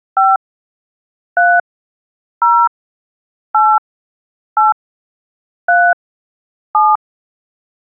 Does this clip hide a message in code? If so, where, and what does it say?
Yes: DTMF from 0.2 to 7.0 s, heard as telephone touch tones, dialled by hand, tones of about 230 ms. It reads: 5 3 0 8 8 3 7